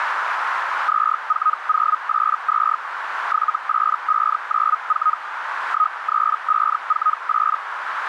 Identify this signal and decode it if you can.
Hellschreiber (Feld-Hell, 122.5 baud), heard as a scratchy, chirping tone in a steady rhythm, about 1260 Hz, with radio static and a narrow filter. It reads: 24082 78594 13548